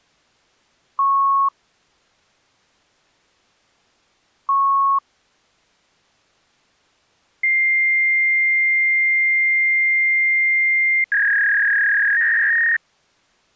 Fax machine handshake, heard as beeps, a long tone and a warble.